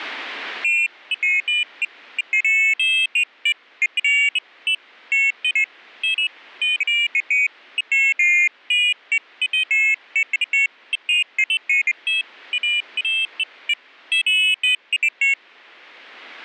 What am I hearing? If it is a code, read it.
Pairs of high tones at irregular times. There is no code.